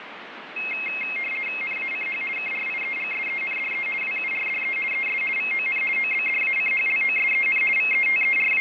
RTTY (50 baud, 450 Hz shift), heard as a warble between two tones, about 2350 Hz centre, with radio static. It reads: NACH KRIEGSENDE WURDE ES VON OBDACHLOSEN …